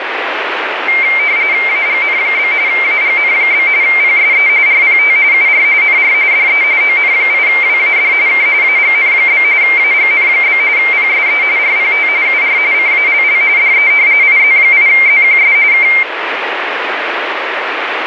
RTTY (45.45 baud, 170 Hz shift), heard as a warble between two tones, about 2200 Hz centre, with radio static. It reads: AGN? AGN? PSE RPT UR NR DE ON8WAD K AGN? AGN? PSE RPT UR CALL DE IZ8ZQS K